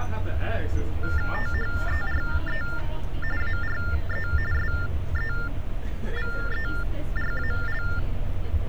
TTY/TDD text telephone tones (45.45 baud Baudot), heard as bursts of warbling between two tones, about 400 Hz shift, 1600 Hz centre, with street noise. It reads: THERE ARE SEVERAL